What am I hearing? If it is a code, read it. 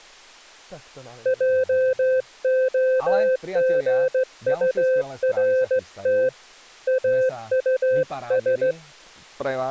Morse code, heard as a keyed tone, hand-sent with a straight key, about 16 wpm, 520 Hz, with speech in Slovak. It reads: JOGURT AUS